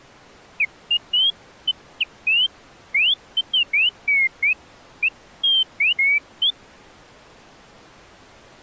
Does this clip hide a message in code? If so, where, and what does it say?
No, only bird-like chirps.